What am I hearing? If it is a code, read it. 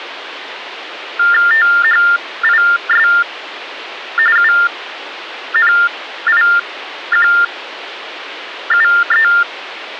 TTY/TDD text telephone tones (45.45 baud Baudot), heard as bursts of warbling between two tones, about 400 Hz shift, 1600 Hz centre, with phone line noise. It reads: THIS UNIQUE